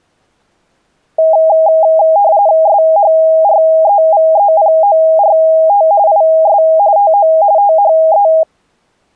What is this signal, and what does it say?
RTTY (45.45 baud, 170 Hz shift), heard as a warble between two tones, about 730 Hz centre. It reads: SHREVEPORT IS TO THE